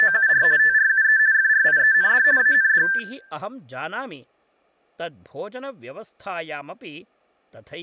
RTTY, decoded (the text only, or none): … TRUE FRIEND AND